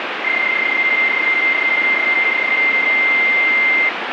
PSK31 (31.25 baud), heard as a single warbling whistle, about 2100 Hz, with radio static.